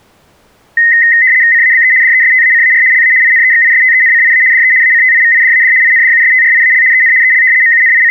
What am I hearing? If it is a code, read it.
RTTY (75 baud, 170 Hz shift), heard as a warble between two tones, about 1950 Hz centre. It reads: CABE DESTACAR LA INEXISTENCIA DE ACTIVIDAD INDUSTRIAL EN EL …